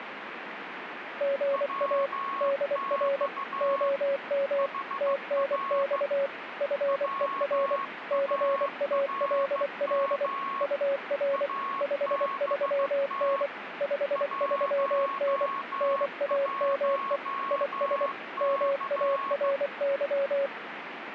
Morse code, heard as two keyed tones, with radio static. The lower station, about 24 wpm, 550 Hz: GA DR OM TNX FER CALL UR 53N 53N NAME IS MARY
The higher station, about 15 wpm, 1100 Hz: WX HR WARM ABT 11C